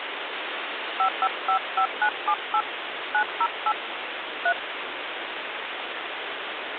DTMF, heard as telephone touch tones, dialled by hand, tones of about 80 ms, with phone line noise. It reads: 5555978 908 3